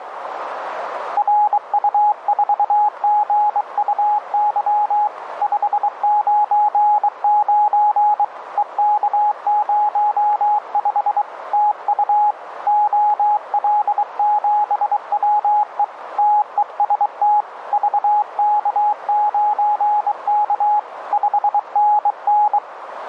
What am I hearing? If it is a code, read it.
Morse code, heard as a keyed tone, hand-sent with a bug key, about 23 wpm, 840 Hz, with radio static and a narrow filter. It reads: RU4GUY 599 EK05 TU OL7WE TEST VK9K 5NN